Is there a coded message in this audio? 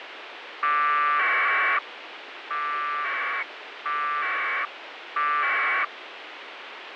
Yes: packet radio (AX.25, as in APRS), 1200 baud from 0.6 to 5.8 s, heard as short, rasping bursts, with radio hiss.